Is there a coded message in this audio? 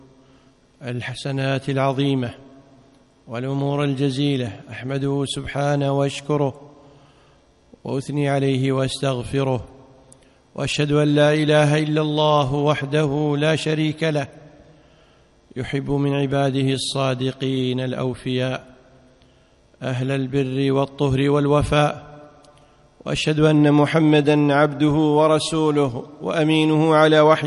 No.